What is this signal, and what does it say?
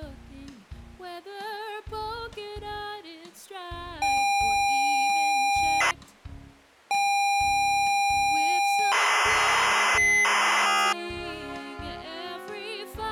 ZX Spectrum tape loading, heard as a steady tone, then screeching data.